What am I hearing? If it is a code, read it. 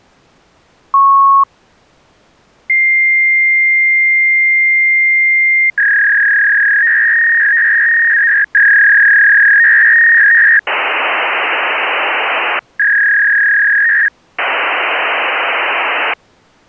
Fax machine handshake, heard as a beep, a long tone, a warble and hiss.